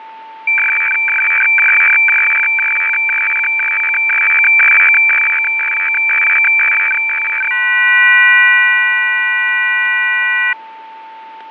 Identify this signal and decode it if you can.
Weather fax (radiofax), 120 lines a minute, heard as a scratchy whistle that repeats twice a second, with fading and a steady whistle near 890 Hz.